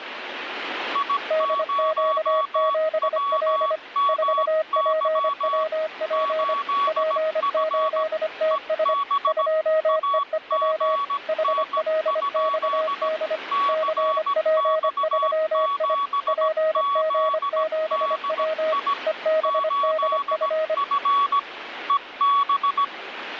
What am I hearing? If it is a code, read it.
Morse code, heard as two keyed tones, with radio static. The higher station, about 17 wpm, 1130 Hz: I0WMY 8F EB AGN? CX7ZDI 8F EB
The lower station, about 25 wpm, 630 Hz: DQ7L 4PWP P8TS 2EEW HLXD CP3I PG7W EBDF